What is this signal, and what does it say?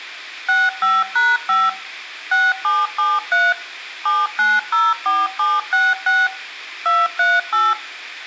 DTMF, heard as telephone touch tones, dialled by machine, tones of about 210 ms, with room echo. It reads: 65#5 6773 7904766 238